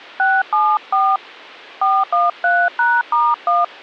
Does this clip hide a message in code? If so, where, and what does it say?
Yes: DTMF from 0.2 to 3.6 s, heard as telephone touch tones, dialled by hand, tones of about 210 ms. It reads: 674 413#*1